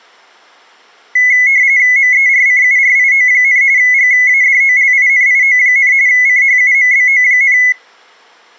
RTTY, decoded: MERCURIO, GADOLINIO, CHUMBO,

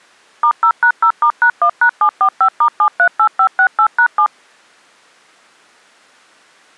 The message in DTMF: *0#0*#1#745*738568#7

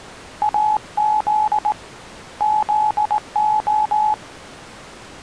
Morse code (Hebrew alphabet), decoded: אז זה

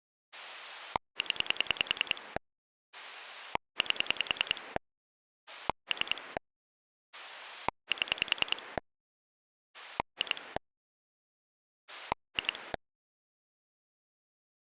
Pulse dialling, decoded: 0 8 3 7 2 2

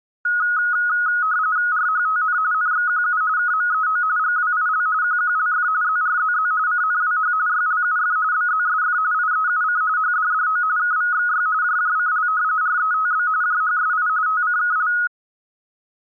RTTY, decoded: RHTN NXQU KMEO GWIL QQLF ZRZZ CNWH YLUF BZSF IEUC HDDO KVXY JJCL RETB JHSI TCKL

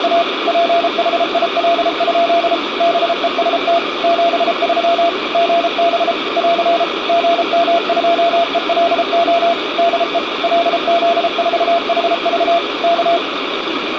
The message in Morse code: … PHIL? BEST 73 GB <AR> GM2ELO DE LZ4HV K

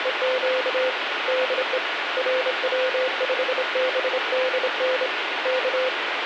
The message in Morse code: … DE RW5BDN K

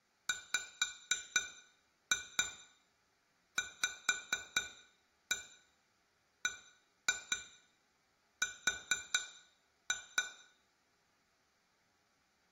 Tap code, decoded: WVBR

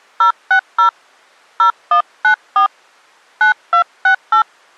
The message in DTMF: 060 0194 9268

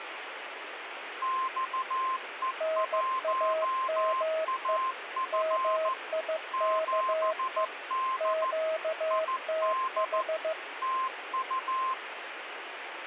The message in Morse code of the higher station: XE1AF 7D ID TU

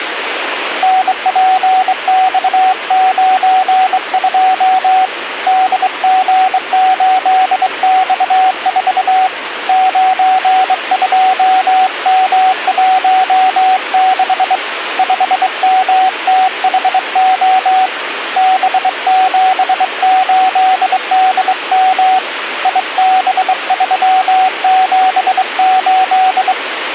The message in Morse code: NPX92 DG8X4 92M16 5MTHO B78DM IB378

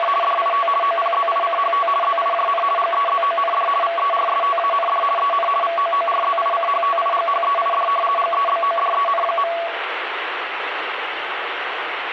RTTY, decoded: … DIT OPZICHT ZIJN GEZOND VERSTAND EN VOORZICHTIGHEID GEBODEN.

